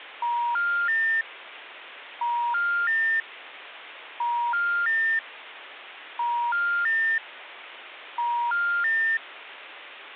Telephone call progress tone (ITU plan), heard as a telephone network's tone, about 950, 1400, 1800 Hz, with phone line noise. Special information tone.